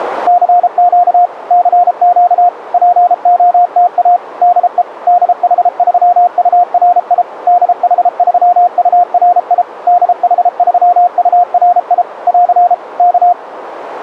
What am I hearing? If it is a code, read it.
Morse code, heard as a keyed tone, machine-sent, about 33 wpm, 710 Hz, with radio static. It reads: CQ CQ POTA DE DH3URI DH3URI DH3URI <AR> K